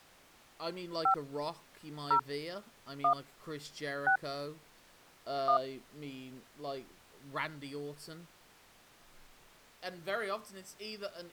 DTMF, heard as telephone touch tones, dialled by hand, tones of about 90 ms, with speech in English. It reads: 5 0 1 6 1